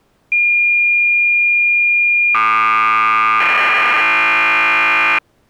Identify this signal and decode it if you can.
Cassette data (Kansas City type), 1200 baud, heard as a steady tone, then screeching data.